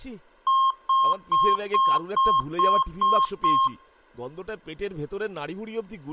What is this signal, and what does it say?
Beep code, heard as beeps from a small speaker, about 1070 Hz, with speech in Bangla. 8 short. In AMI BIOS tables: display memory failure; in Dell tables: LCD failure.